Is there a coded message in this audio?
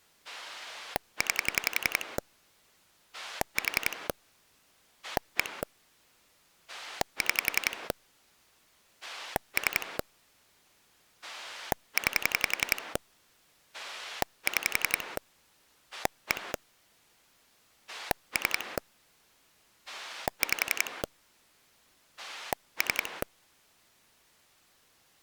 Yes: pulse dialling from 0.2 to 23.2 s, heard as a rotary dial, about 11 pulses a second. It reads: 9 4 1 6 3 9 6 1 3 5 3